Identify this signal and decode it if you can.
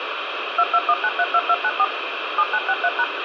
DTMF, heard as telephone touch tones, dialled by machine, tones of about 50 ms, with radio hiss. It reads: 221932294 7963#